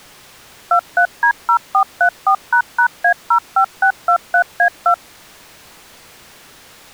DTMF, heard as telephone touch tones, dialled by machine, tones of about 80 ms. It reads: 23D0434##A05623A2